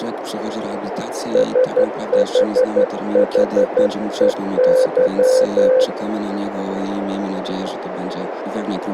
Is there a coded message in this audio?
Yes: Morse code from 1.3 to 5.9 s, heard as a keyed tone, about 12 wpm, 520 Hz, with radio static and a narrow filter. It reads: SHHEY